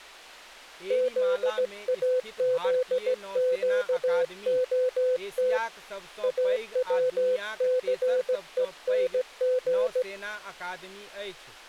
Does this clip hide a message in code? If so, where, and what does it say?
Yes: Morse code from 0.8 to 10.1 s, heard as a keyed tone, hand-sent with a straight key, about 17 wpm, 510 Hz, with speech in Maithili. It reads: ZAZQOT AWCENG